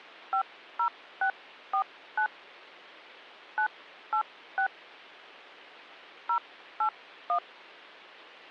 DTMF, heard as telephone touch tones, dialled by hand, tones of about 90 ms. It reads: 50649 986 081